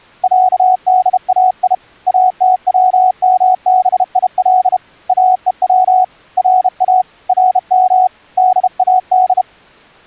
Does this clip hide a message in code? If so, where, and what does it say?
Yes: Morse code (Persian alphabet) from 0.2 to 9.5 s, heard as a keyed tone, hand-sent with a bug key, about 32 wpm, 740 Hz. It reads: صدای اتومبیل اهو را رم داد